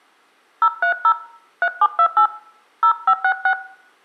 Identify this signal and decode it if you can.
DTMF, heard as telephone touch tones, dialled by hand, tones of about 80 ms, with room echo. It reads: 030 3728 0566